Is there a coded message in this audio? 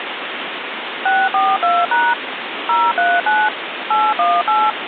Yes: DTMF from 1.1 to 4.7 s, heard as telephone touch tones, dialled by machine, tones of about 220 ms, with phone line noise. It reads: 642# 039 818